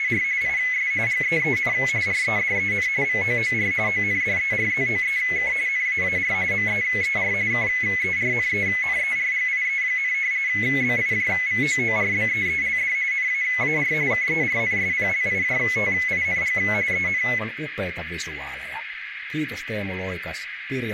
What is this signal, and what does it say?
RTTY (45.45 baud, 170 Hz shift), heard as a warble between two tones, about 2100 Hz centre, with radio static, a narrow filter and speech in Finnish. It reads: … IS GEEN REDEN VOOR ONDERZOEK NAAR MEER KERNENERGIE, BIJVOORBEELD NAAR KERNSPLIJTING EN